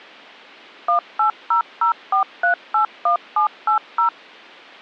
DTMF, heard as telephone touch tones, dialled by machine, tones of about 110 ms. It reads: 18004381780